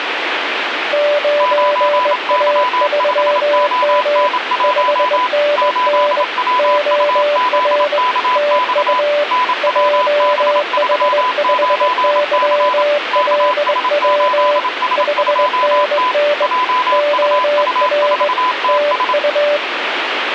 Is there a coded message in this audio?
Yes: Morse code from 0.9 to 19.6 s, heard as two keyed tones, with radio static. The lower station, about 21 wpm, 590 Hz: 9A3M 5NN OR TU JH5YLW 5NN OR TU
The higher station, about 27 wpm, 1000 Hz: 9Y5ON1 8WUZKX NWB39C KS8S2T JUU4TS